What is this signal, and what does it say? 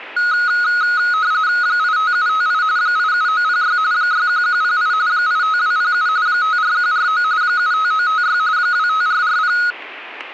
RTTY (45.45 baud, 170 Hz shift), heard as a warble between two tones, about 1360 Hz centre. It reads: 85758 87906 61108 85207 54149 75956 25440